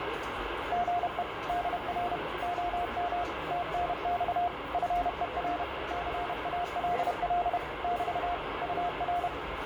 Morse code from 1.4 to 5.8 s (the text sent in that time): DR OM TNX FER